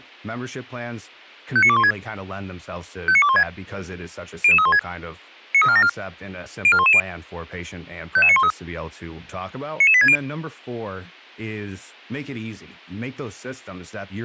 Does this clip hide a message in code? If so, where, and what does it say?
Yes: five-tone selective call (ZVEI) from 1.6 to 10.2 s, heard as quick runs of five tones, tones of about 70 ms, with speech in English. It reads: 59216 59216 00316 93474 04110 55913 99860